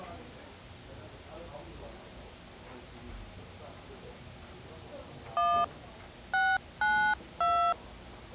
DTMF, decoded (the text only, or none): 1 692